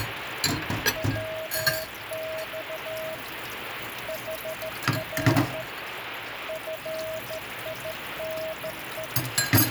Morse code, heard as a keyed tone, hand-sent with a straight key, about 14 wpm, 640 Hz, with radio static and kitchen noise. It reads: WX HR FINE